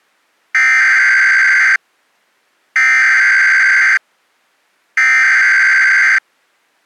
Emergency Alert System (SAME) tones (header bursts), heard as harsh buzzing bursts, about 520.83 baud.